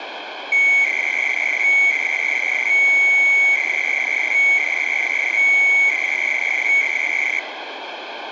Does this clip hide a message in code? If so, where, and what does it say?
Yes: 300-baud modem data (Bell 103 tones) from 0.5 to 7.4 s, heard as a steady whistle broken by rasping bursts, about 300 baud, 200 Hz shift, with phone line noise.